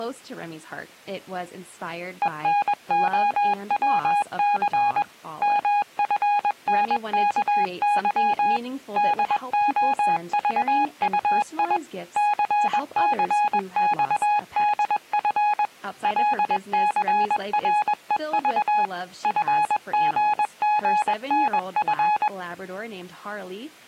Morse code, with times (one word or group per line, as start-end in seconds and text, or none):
2.2-5.0 ENOWC
5.4-8.6 MFNKY
9.0-11.8 DOVUI
12.2-15.7 CCXDF
16.0-18.9 LCREV
19.2-22.3 FGGNF